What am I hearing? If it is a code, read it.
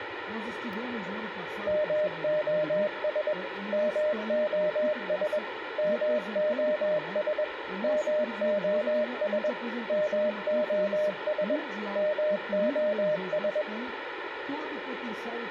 Morse code, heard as a keyed tone, machine-sent, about 21 wpm, 610 Hz, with radio hiss, a squelch burst at the end and room echo. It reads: MOS MOS MOS MOS MOS MOS